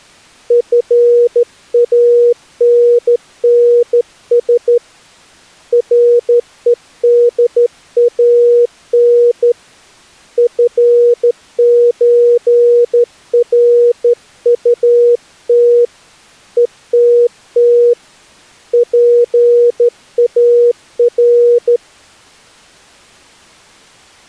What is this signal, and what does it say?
Morse code (with Swedish letters), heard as a keyed tone, hand-sent with a straight key, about 13 wpm, 480 Hz. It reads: FANNS REDAN FÖRUT ETT PAR